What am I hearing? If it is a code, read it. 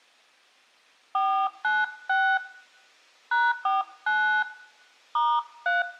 DTMF, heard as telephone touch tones, dialled by hand, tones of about 290 ms, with room echo. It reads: 496 #49 *3